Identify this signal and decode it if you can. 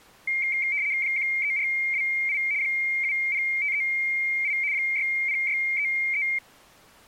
RTTY (75 baud, 170 Hz shift), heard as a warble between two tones, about 2200 Hz centre. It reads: 13428 70538 60633